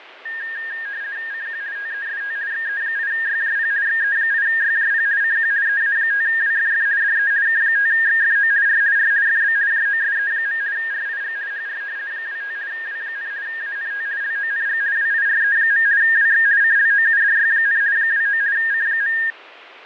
RTTY (50 baud, 170 Hz shift), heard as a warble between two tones, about 1750 Hz centre, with radio static and fading. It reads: CQ TEST XE8YJP XE8YJP CQ EA5WFF DE K5XFO R R FB JOSE. RIG HR 25 W, ANT LONG WIRE. WX CLOUDY, 29 C.